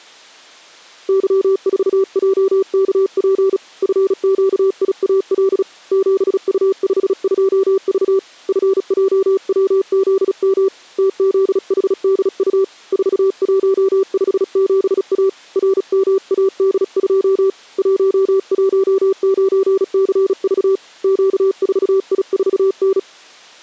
Morse code, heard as a keyed tone, hand-sent with a paddle, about 36 wpm, 390 Hz. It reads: Y4JKP FQIAL 7U52V FJWZM TZHDU 4157A RMAD2 119CV Q4I4N